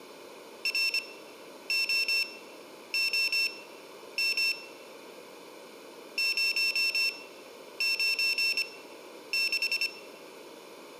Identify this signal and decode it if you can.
Morse code, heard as a high beeper, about 25 wpm, spaced as for 10 wpm, 2700 Hz, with room echo. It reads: ROOM 096